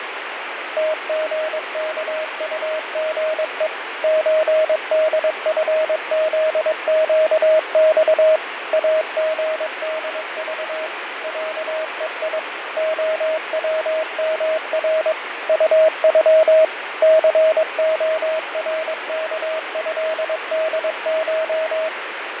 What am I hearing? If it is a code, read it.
Morse code (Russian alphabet), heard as a keyed tone, machine-sent, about 22 wpm, 630 Hz, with radio static and fading. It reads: ТГКУГЕ ЧДФЗЩЬ АГДЖ ЯЕИ ОВМР УЮ ЦОРКЭДШ